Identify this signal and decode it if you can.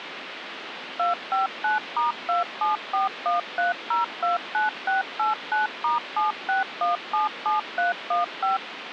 DTMF, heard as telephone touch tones, dialled by machine, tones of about 140 ms, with phone line noise. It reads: 259*27413029689*76177315